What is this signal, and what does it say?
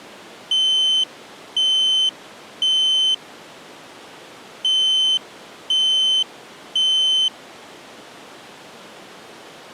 Alarm pattern, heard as an alarm's beeps, played twice, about 3050 Hz. Temporal three. Smoke or fire, evacuate.